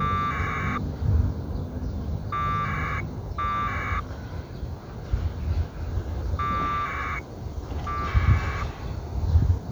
Packet radio (AX.25, as in APRS), 1200 baud, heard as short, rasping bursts, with the noise of a park.